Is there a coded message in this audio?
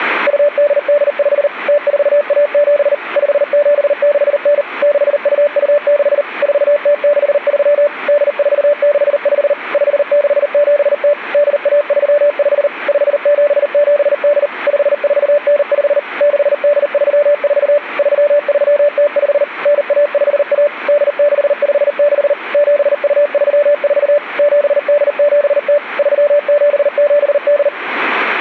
Yes: Morse code (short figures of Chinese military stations) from 0.2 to 27.7 s, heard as a keyed tone, machine-sent, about 39 wpm, 580 Hz. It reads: 2885 0417 5769 6226 4063 8465 5670 8135 5778 5495 6834 3305 9151 8656 7234 7870 3778